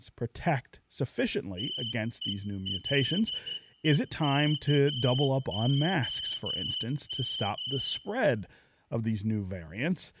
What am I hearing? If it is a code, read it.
Morse code, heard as a whistle, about 12 wpm, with room echo and speech in English. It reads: TELEKOM